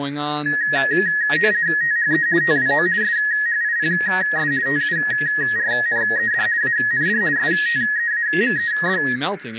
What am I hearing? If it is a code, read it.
RTTY (50 baud, 170 Hz shift), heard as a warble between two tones, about 1800 Hz centre, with radio static, a narrow filter and speech in English. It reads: THE TWO SHIPS TURNED AND STEAMED